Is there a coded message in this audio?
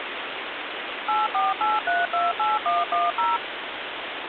Yes: DTMF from 1.1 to 3.4 s, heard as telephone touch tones, dialled by machine, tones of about 180 ms, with phone line noise. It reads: 848328110